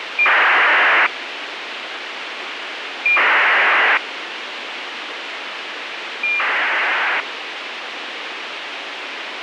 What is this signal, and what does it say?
ACARS aircraft data, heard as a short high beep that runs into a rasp, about 2400 baud, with radio hiss.